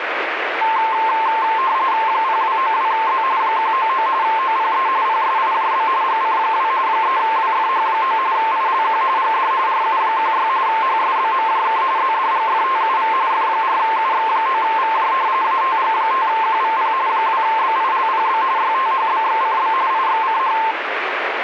RTTY (45.45 baud, 170 Hz shift), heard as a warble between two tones, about 970 Hz centre, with radio static. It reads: 0292Z 199 OPE PSIJB GC2 3WFH9 ILQ GD RU16 HSBMJK ZDGFTUV F4UX9VJ ATG5QVP 2BILPB YTHBXCB IXCH